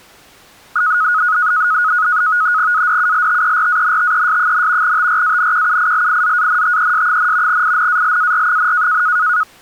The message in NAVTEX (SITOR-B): ADULTERANTES, TRANQUILIZANTES, INALAR,

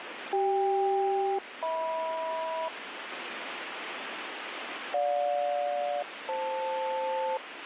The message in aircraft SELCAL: CK-HM GJ-FL

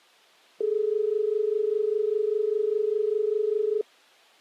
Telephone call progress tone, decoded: dial tone

